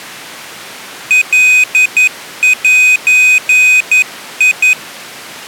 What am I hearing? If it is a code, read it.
Morse code (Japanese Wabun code), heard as a high beeper, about 11 wpm, 2500 Hz. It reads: カゼ